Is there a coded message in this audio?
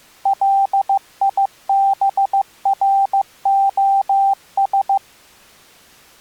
Yes: Morse code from 0.2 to 5.0 s, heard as a keyed tone, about 15 wpm, 790 Hz. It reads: LIBROS